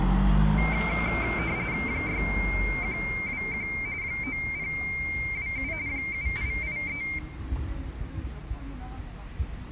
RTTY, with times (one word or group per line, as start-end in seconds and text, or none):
1.9-3.7 6121
4.0-5.7 9027
5.9-7.0 7883